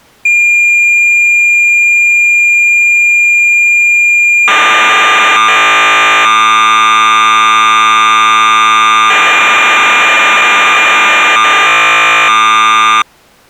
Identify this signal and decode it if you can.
Cassette data (Kansas City type), 1200 baud, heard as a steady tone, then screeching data.